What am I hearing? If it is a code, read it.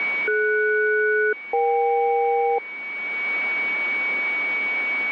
Aircraft SELCAL, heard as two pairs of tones, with a steady whistle near 2250 Hz. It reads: DS-EK